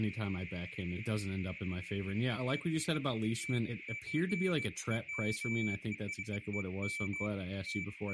Beeps of irregular length, with radio static, a narrow filter and speech in English. There is no code.